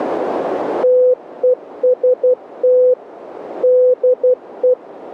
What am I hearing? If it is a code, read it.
Morse code, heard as a keyed tone, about 12 wpm, 500 Hz, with radio static. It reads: TEST DE